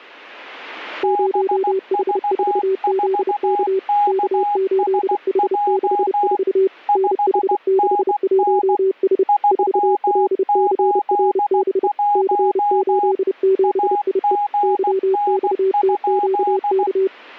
Morse code, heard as two keyed tones. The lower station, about 30 wpm, 380 Hz: 0H4ZK K8H64 NH61S 4LCRB C87IE YXTQK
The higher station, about 16 wpm, 820 Hz: BV4KSJ 5NN 381 AGN?